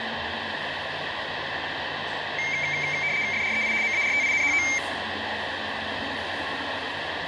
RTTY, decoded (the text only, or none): FREI MARTINHO